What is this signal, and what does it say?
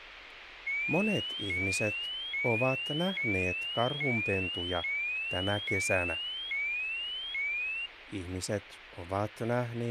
A tone that sweeps in pitch again and again, with radio hiss and speech in Finnish. There is no code.